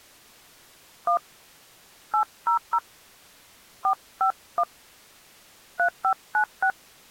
DTMF, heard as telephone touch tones, dialled by hand, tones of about 80 ms. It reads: 1 800 451 3596